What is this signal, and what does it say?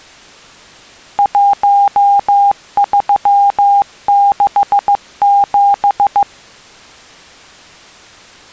Morse code, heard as a keyed tone, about 15 wpm, 800 Hz. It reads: 1367